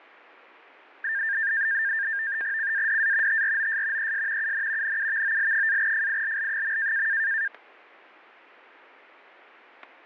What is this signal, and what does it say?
NAVTEX (SITOR-B), 100 baud, 170 Hz shift, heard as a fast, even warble, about 1700 Hz centre, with static crashes. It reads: CADA TROS ES UN NUVOL-FILL.